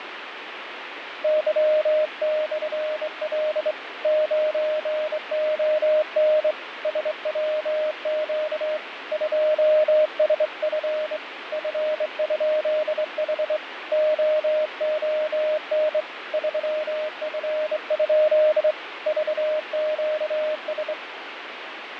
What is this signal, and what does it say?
Morse code, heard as a keyed tone, hand-sent with a straight key, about 24 wpm, 620 Hz, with radio static and fading. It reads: Y/L 9ON SWQ 2SF F?H OON 3F? VQS